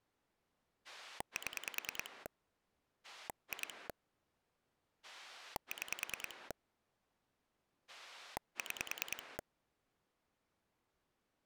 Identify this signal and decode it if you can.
Pulse dialling, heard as a rotary dial, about 10 pulses a second. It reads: 7 2 6 6